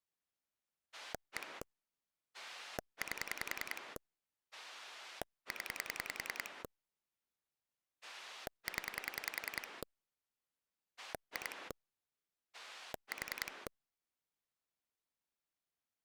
Pulse dialling, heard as a rotary dial, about 10 pulses a second. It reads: 1 8 0 0 2 4